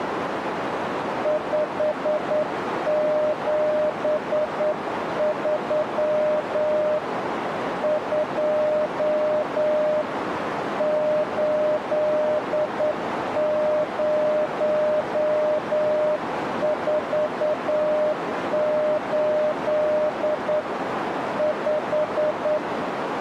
Morse code, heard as a keyed tone, hand-sent with a straight key, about 9 wpm, 610 Hz, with radio static and a narrow filter. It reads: 573 2 8048 5